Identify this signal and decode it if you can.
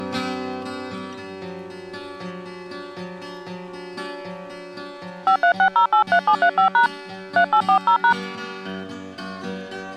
DTMF, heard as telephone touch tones, dialled by hand, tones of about 90 ms. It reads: 536083735# 3840#